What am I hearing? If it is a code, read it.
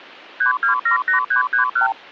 Multi-frequency trunk signalling (R2, with the far end's replies), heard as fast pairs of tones, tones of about 110 ms. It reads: 3278331